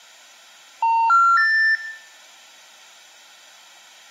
Telephone call progress tone (North American plan), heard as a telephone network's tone, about 910, 1370, 1800 Hz, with room echo. Special information tone.